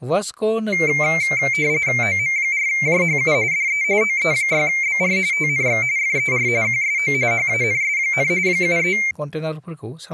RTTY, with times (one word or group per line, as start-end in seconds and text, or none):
2.0-3.3 OM4JHU
3.5-3.8 DE
4.0-5.2 OE6BR
5.3-5.8 TNX
6.0-6.5 FER
6.6-7.1 QSO
7.3-8.3 HANS,
8.5-9.0 73